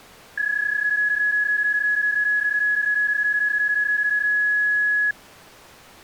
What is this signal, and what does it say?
PSK31 (31.25 baud), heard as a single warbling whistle, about 1700 Hz.